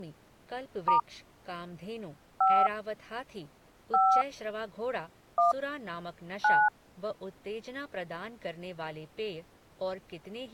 DTMF, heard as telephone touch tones, dialled by hand, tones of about 210 ms, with speech in Hindi. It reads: * 5 5 1 9